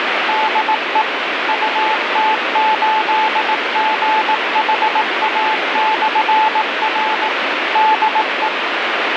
Morse code, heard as a keyed tone, machine-sent, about 18 wpm, 870 Hz, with heavy radio static. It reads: DE UT8GHA/R DE